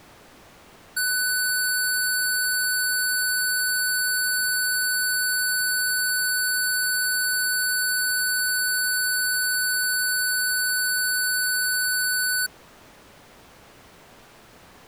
A steady tone. There is no code.